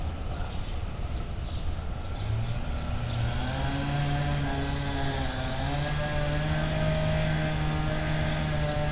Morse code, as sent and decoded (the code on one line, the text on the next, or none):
none